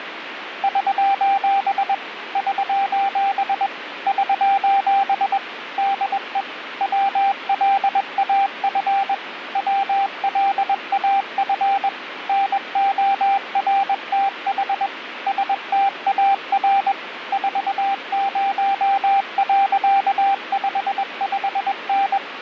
Morse code, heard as a keyed tone, machine-sent, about 21 wpm, 790 Hz, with radio static. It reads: <SOS> <SOS> <SOS> DE WLAF WLAF NORTH STAR 40.55N